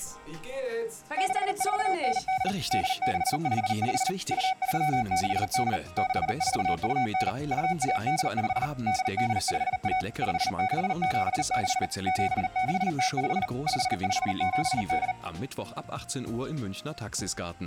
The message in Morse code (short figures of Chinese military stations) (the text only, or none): 6498 8655 2368 6429 2185 8851 5676 7605 5578